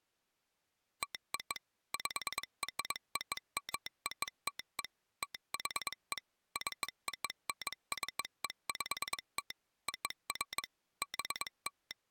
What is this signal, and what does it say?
Morse code (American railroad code), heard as a telegraph sounder, machine-sent. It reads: TO PROMOTE THE CONCEPT OF …